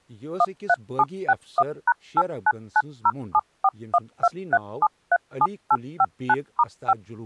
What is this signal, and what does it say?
DTMF, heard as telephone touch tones, dialled by machine, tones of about 50 ms, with speech in Kashmiri. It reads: 13761#899074123737859*5